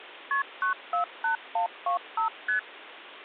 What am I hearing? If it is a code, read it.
Multi-frequency trunk signalling (R1, as on North American trunks), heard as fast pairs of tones, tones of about 110 ms, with phone line noise. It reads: KP 948125 ST